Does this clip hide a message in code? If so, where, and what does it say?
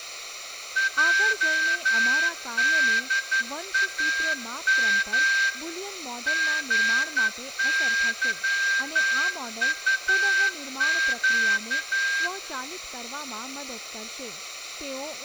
Yes: Morse code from 0.7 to 12.3 s, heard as a whistle, hand-sent with a straight key, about 11 wpm, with speech in Gujarati. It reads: JDAM GYUQ